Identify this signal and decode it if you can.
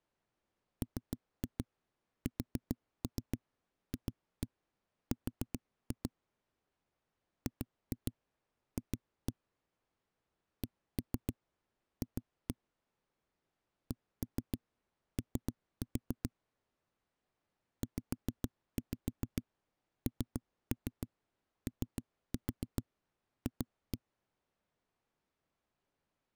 Tap code, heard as knocks on a wall, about 7 knocks a second. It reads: MSFR GF CF CO ZNOF